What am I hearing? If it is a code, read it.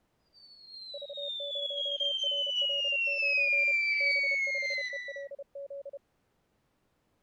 Morse code, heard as a keyed tone, hand-sent with a paddle, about 31 wpm, 560 Hz. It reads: V0RL9 B5ELZ